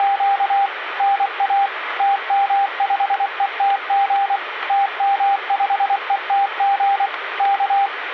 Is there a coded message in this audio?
Yes: Morse code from 0.0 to 7.9 s, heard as a keyed tone, machine-sent, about 24 wpm, 800 Hz, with radio static. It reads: … NA TM5ETG TM5ETG K